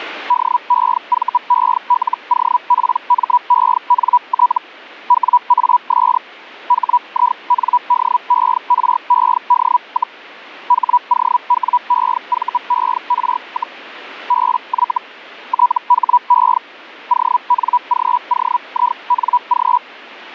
Hellschreiber (Feld-Hell, 122.5 baud), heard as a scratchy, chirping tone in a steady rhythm, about 980 Hz. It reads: DEVELOPMENT WAS HINDERED, HOWEVER, BY THE ONGOING